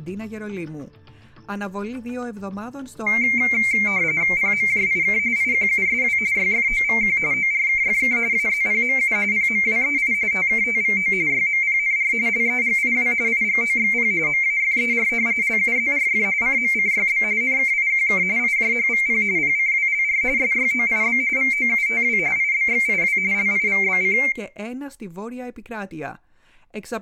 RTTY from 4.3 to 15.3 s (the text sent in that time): PMJIK IQUSW YFOVQ ORKFK AZPMU PMWEI TKTVO YMPNR LEGIW IGOXP MAFER